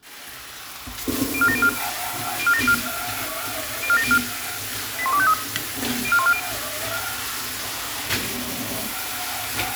Five-tone selective call (ZVEI), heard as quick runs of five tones, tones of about 70 ms, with kitchen noise. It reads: 04704 04704 04704 81253 04140